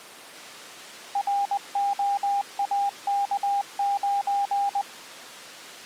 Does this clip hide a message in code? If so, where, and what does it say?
Yes: Morse code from 1.1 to 4.9 s, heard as a keyed tone, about 20 wpm, 800 Hz. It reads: ROAK9